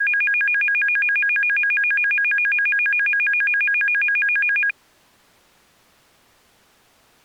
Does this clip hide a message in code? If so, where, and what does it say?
No, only a tone that alternates evenly between two pitches.